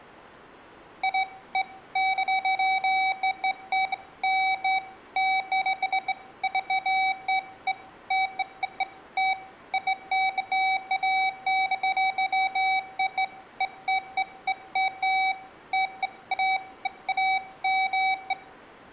Beeps of irregular length, with room echo. There is no code.